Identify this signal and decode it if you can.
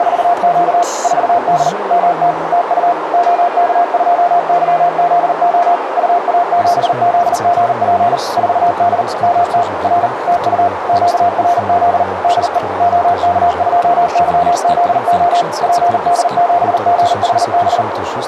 Morse code, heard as a keyed tone, machine-sent, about 39 wpm, 700 Hz, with radio static and a narrow filter. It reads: … 4D MT TU OK2YZO UA7ZGP 4D MT R TU QRZ DE OK2YZO PD7GHB